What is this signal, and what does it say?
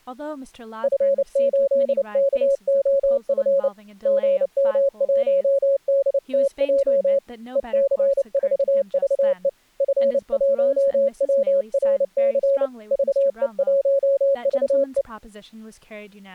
Morse code, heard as a keyed tone, hand-sent with a paddle, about 29 wpm, 550 Hz, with speech in English. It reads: F8KOF GM1DTJ EC4VE F1WRC VE1VE